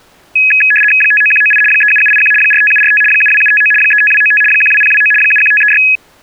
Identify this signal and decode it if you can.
RTTY (75 baud, 850 Hz shift), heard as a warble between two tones, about 2100 Hz centre. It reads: 59198 37781 45745 72759 35295 12029 71536